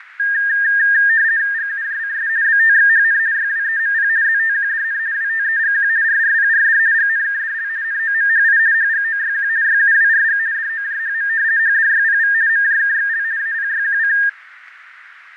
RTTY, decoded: GUJCS BTXHN YWEMP ZTQDN WTEGQ RRPRD GNKDL NOMHI HGOYQ YUWRG DOJHM HDYPV MJKXL APYQC

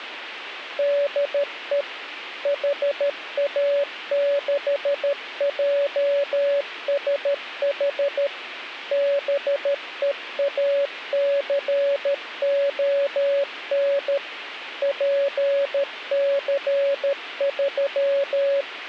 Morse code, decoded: DE HA6JSH BEACON …

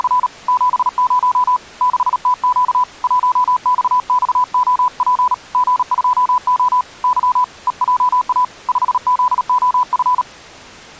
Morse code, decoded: … 70 6TQ 1XXOP G2O Y EJA 5ZOF

